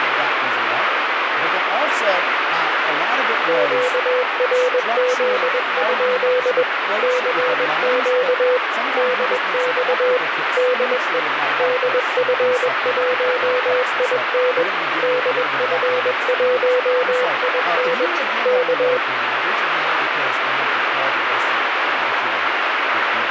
Morse code, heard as a keyed tone, machine-sent, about 21 wpm, 500 Hz, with radio static. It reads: QRZ? CQ DX DE DF1IN DF1IN K